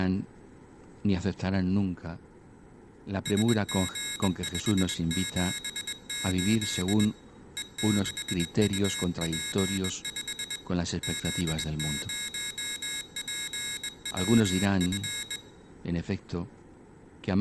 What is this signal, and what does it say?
Morse code, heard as a high beeper, hand-sent with a bug key, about 21 wpm, 3800 Hz, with room echo. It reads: SG578 E6UP5 Z0PWF